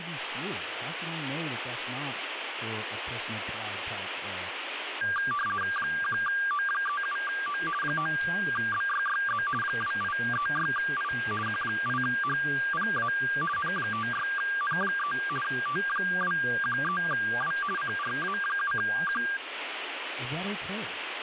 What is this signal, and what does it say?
RTTY (50 baud, 450 Hz shift), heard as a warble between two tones, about 1390 Hz centre, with radio static and speech in English. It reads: 1O37O 9BYYZ 2836I Q8HPA N56N3 T213W CRA7Q